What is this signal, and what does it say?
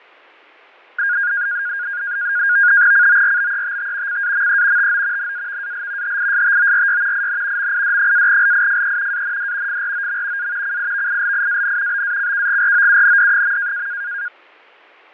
NAVTEX (SITOR-B), 100 baud, 170 Hz shift, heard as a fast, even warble, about 1550 Hz centre, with fading. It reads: CORBETT CAME TO NAVAL HISTORY IN MID-LIFE AND FROM A CIVILIAN BACKGROUND.